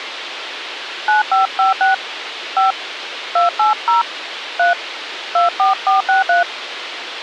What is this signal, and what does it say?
DTMF, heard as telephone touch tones, dialled by hand, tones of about 140 ms, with radio hiss. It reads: 9556 5 280 3 24463